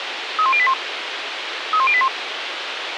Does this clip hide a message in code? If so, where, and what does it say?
Yes: five-tone selective call (ZVEI) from 0.4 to 2.1 s, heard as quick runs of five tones, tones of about 70 ms, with radio hiss. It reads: 31081 31081